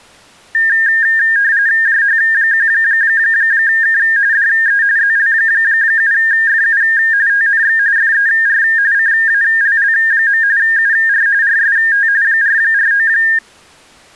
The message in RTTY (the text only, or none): JH1K DE ZL7FU TNX FER CALL. UR RST 449